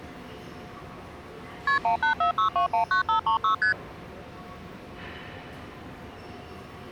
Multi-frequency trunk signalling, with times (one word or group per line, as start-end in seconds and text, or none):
1.7-1.8 KP
1.8-3.5 1846219536
3.6-3.7 ST